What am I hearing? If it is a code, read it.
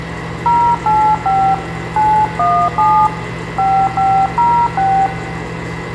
DTMF, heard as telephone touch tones, dialled by hand, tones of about 290 ms, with phone line noise and kitchen noise. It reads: 085 917 5506